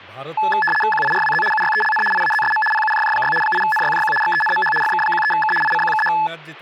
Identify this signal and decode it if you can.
RTTY (75 baud, 850 Hz shift), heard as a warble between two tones, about 1290 Hz centre, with static crashes and speech in Odia. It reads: QIRWZ UYELN IAZSM PUJJ6 8NYJQ XENMH FK13K ICQKH